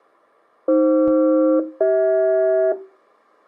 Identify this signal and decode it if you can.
Aircraft SELCAL, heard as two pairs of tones. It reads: AF-CH